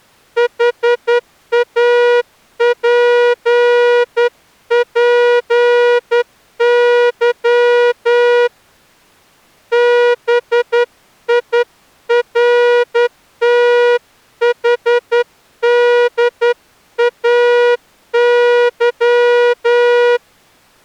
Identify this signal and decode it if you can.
Morse code, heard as a horn, hand-sent with a straight key, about 10 wpm. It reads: HAPPY BIRTHDAY